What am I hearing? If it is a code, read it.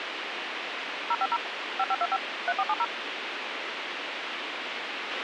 DTMF, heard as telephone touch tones, dialled by machine, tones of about 50 ms, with radio hiss and a squelch burst at the end. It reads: 050 5525 3470